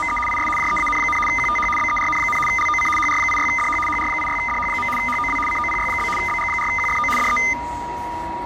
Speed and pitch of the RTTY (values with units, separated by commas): 75 baud, 850 Hz shift, 1650 Hz centre